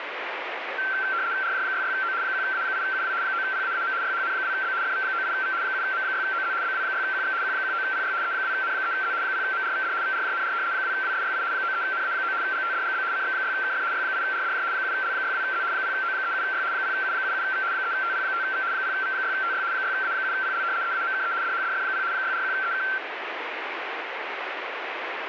RTTY (75 baud, 170 Hz shift), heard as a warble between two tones, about 1460 Hz centre, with radio static. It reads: RJ66O 1A8UW 9PAAM YHN2B FV98V 7M6OZ BW6QX Q19PY E2N3Z 0MRVD VRJNR 2WSYI 93NA9 GTDGB CX6KF Y8RDJ 7L62Z 0O37Y 0U77V 3TP5V 0V6TY 6A7PL EAMKE DHDF0 641EK